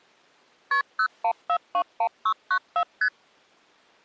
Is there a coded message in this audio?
Yes: multi-frequency trunk signalling (R1, as on North American trunks) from 0.7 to 3.1 s, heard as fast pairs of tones, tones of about 70 ms. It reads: KP 01421694 ST